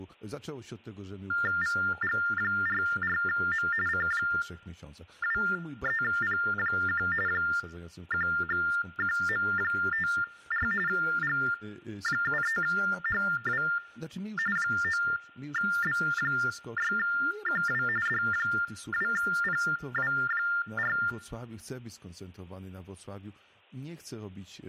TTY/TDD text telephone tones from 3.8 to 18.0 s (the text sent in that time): C23P1 1QM54 G73HW 9B6QW